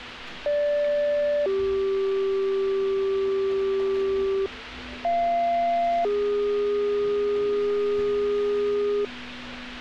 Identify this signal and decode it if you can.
Two-tone page, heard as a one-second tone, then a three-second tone, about 580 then 390 Hz, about 690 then 410 Hz, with street noise.